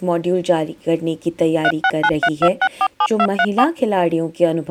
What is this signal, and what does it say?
DTMF, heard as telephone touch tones, dialled by machine, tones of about 60 ms. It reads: 36932647234